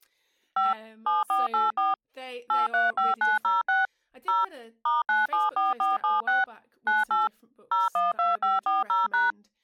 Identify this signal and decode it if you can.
DTMF, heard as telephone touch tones, dialled by machine, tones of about 170 ms, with speech in English. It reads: 5 7484 835906 0 *974476 98 012540#